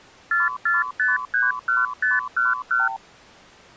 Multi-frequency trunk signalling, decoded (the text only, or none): 44531511